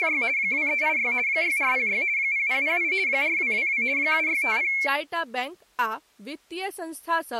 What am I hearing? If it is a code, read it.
RTTY (50 baud, 170 Hz shift), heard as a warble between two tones, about 2250 Hz centre, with speech in Maithili. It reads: … 2386 6406 0008 4222 7650